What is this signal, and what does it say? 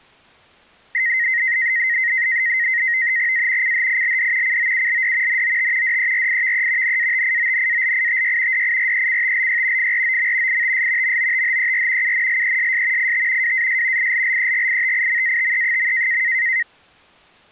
NAVTEX (SITOR-B), 100 baud, 170 Hz shift, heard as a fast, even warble, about 1950 Hz centre. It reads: A CHILD COULD NOT DERIVE NATIONALITY DIRECTLY FROM ITS MOTHER UNLESS IT WAS ILLEGITIMATE.